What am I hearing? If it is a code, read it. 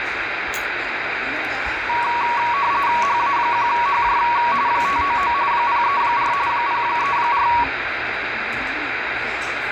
RTTY (45.45 baud, 170 Hz shift), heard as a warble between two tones, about 1040 Hz centre, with radio static and the noise of a restaurant. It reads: HA1HJ 599 034 034